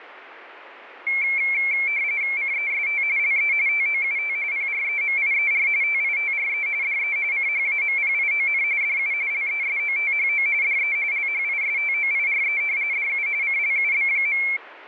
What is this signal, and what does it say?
RTTY (45.45 baud, 170 Hz shift), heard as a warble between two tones, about 2250 Hz centre. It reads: CEST LE TOUT PREMIER TITRE DE CHAMPION DU LESOTHO DE LHISTOIRE DU CLUB.